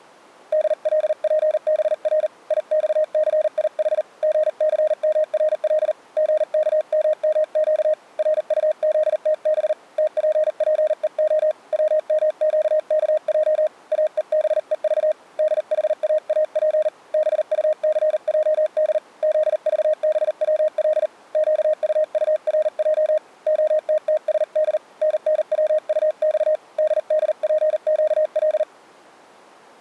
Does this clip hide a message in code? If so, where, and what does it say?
Yes: Morse code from 0.5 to 28.7 s, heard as a keyed tone, hand-sent with a paddle, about 39 wpm, 620 Hz. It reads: DLPBR IXCIH GCMRL GKMMQ RUZTB TPPEO WMQKJ AEBEV DHAAP BUCJD ZVBWL QUURJ OTTSD NNWUX DDPQL